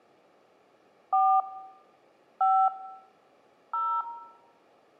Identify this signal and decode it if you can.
DTMF, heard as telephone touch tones, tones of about 280 ms, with room echo. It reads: 4 5 0